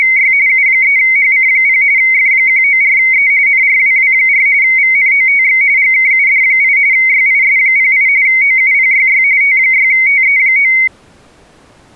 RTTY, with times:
0.0-0.3 …
0.5-1.8 U3HC0
2.0-3.3 F194E
3.5-4.5 NRWW4
4.6-5.6 VNOTX
5.8-6.8 GKUD8
6.9-8.1 YIS08
8.3-9.2 OUPYY
9.4-10.7 T6TE9

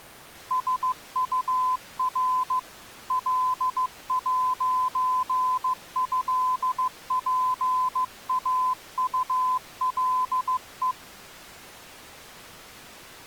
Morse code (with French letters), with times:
0.5-2.6 SUR
3.1-10.9 L'ÉPAULE

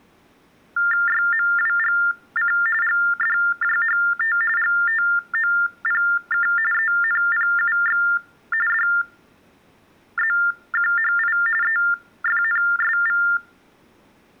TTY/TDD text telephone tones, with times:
1.1-2.5 YMWGC
2.8-4.4 GDJHT
4.6-6.5 GTOPK
6.7-8.0 ENPUX
8.7-11.4 DZQHI
11.6-13.2 EFNSV

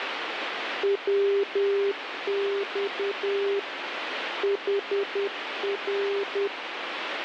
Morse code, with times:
0.8-3.6 WX
4.4-6.5 HR

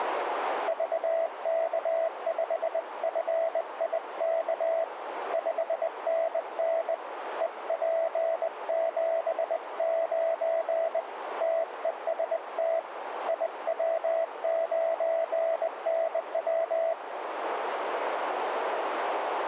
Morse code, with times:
0.7-4.8 VK5FIK
5.3-6.9 5NN
7.4-11.0 EP79
11.4-12.8 TEST
13.3-16.9 IW9NW

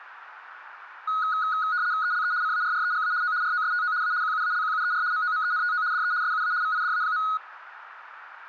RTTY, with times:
2.0-2.3 ELE
2.4-3.1 CARREGA
3.2-3.3 O
3.4-3.9 ROSTO
4.0-4.1 A
4.2-5.0 QUALQUER
5.1-5.8 MOMENTO
5.9-6.1 DE
6.2-6.5 SUA
6.6-7.2 VIDA.

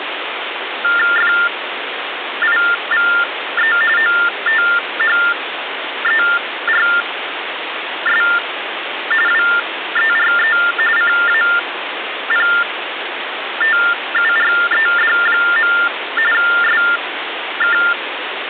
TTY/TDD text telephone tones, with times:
1.2-3.8 FIVE
4.0-8.2 OTHERS
9.3-10.6 WERE
11.0-15.7 CAPTURED.
16.3-17.8 SK

